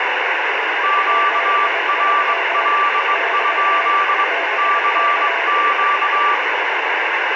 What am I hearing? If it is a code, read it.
Morse code, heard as two keyed tones, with heavy radio static. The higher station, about 21 wpm, 1170 Hz: QRL? CQ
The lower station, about 22 wpm, 680 Hz: 73 <BT> BK